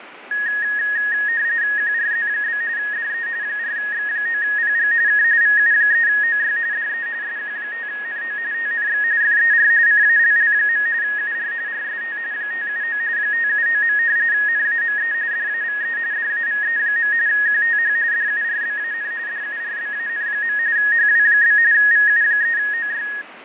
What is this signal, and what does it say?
RTTY (45.45 baud, 170 Hz shift), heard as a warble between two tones, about 1750 Hz centre, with radio static and fading. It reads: QRZ? DE 4X9PG K VU3OY DE SQ5NO TNX FER CALL. UR RST 579 579. NAME DAVE DAVE. QTH DURBAN DURBAN. HW? VU3OY